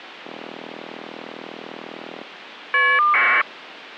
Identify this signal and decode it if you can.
Caller ID data burst, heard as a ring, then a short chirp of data, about 1200 baud.